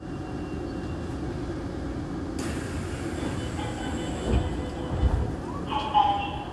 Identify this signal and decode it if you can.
The noise inside a subway train. There is no code.